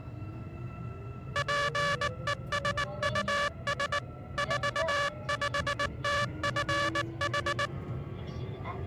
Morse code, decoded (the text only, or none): PESUS 45TFH